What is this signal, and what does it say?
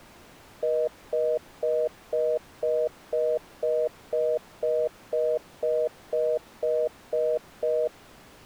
Telephone call progress tone (North American plan), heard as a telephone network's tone, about 480, 620 Hz, 0.25 s on and 0.25 s off. Congestion tone.